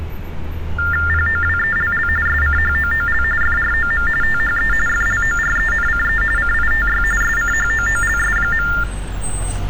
TTY/TDD text telephone tones (45.45 baud Baudot), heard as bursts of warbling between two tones, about 400 Hz shift, 1600 Hz centre, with street noise. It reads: POWELL SCHOOL FROM THE FLORENCE CITY SCHOOLS.